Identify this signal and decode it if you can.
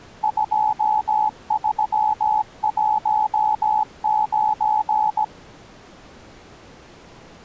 Morse code, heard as a keyed tone, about 17 wpm, 860 Hz. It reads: 2319